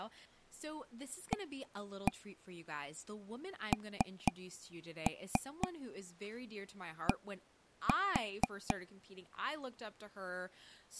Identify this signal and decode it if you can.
Tap code, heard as taps on a table, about 4 knocks a second, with speech in English. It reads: AND